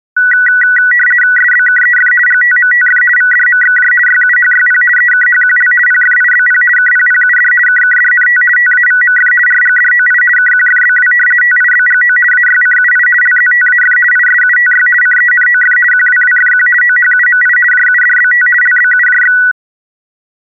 RTTY (50 baud, 450 Hz shift), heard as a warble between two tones, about 1700 Hz centre. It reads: SBKEF GTMTF VDMXJ YUHYP EKHQL PFIBP KPPUD KKDNT TAVMF RGDOI KQFBW TIBGO AYCUI LZTAF ISUTY CENOF QWWFQ OHUMI JUDBT LBUJX